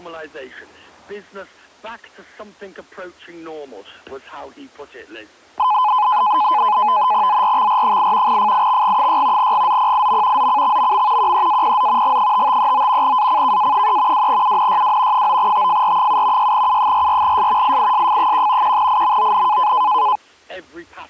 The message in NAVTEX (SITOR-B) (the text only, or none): ZRXR8 FIXG6 GZPIM ZCXMM QEAPZ G5539 ACKA3 2UNYW 9TFR7 6U44S IISF1 1IMON